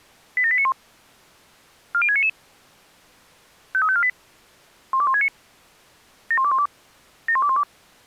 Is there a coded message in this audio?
Yes: five-tone selective call (ZVEI) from 0.4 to 7.6 s, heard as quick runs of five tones, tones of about 70 ms. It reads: 87891 40699 53548 12169 71212 71212